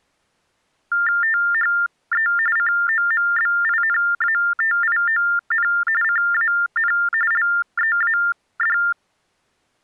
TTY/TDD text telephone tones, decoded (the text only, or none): THE COMBINATION CAN LEAD